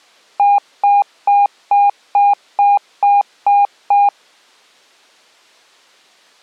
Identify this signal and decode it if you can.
Beep code, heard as beeps, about 810 Hz. 9 short. In AMI BIOS tables: ROM checksum failure.